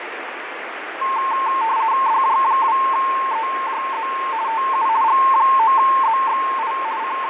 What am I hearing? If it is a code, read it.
RTTY (50 baud, 170 Hz shift), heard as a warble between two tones, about 980 Hz centre, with radio static and fading. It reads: DJ2EJZ TU G9ZXI …